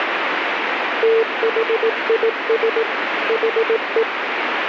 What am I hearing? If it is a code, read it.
Morse code, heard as a keyed tone, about 18 wpm, 450 Hz, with heavy radio static. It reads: THIS HE